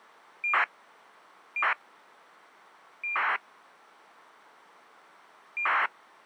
ACARS aircraft data, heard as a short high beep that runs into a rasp, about 2400 baud.